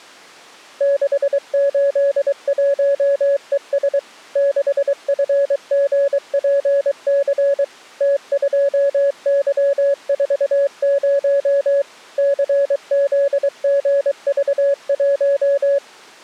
Morse code, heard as a keyed tone, machine-sent, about 23 wpm, 560 Hz. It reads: 681ES 6FGPC T2Y40 CZGV1